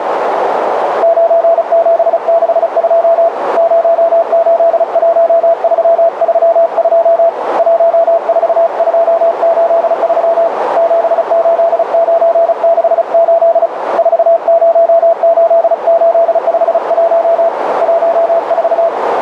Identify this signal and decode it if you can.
Morse code, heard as a keyed tone, hand-sent with a paddle, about 35 wpm, 670 Hz, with heavy radio static and a narrow filter. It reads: 9762 081332 14283 78968 408851 14